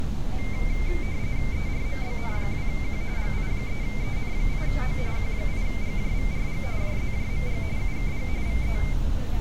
RTTY (45.45 baud, 170 Hz shift), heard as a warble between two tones, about 2200 Hz centre, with street noise. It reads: ERMBN2Q GI3EN8O Q8GJVRG JZJMG UKG VE